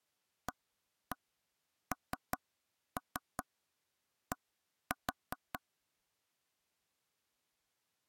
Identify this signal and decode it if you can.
Tap code, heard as taps on a table, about 5 knocks a second. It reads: AND